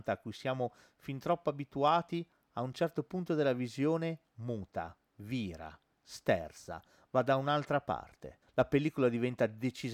Speech in Italian. There is no code.